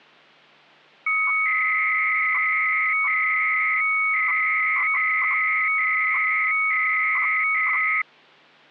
300-baud modem data (Bell 103 tones), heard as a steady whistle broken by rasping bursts, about 300 baud, 200 Hz shift.